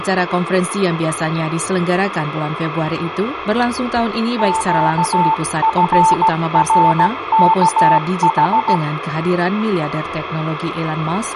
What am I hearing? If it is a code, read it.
Morse code, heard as a keyed tone, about 16 wpm, 890 Hz, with radio static. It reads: QFRKH